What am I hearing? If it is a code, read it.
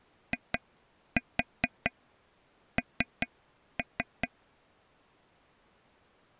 Tap code, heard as taps on a table, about 4 knocks a second. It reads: IN